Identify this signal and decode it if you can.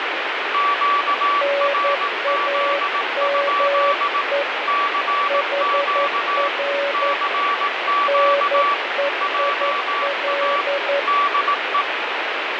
Morse code, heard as two keyed tones, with heavy radio static. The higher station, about 18 wpm, 1150 Hz: QRZ? CQ CQ JA DE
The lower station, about 11 wpm, 560 Hz: NAME HR NEIL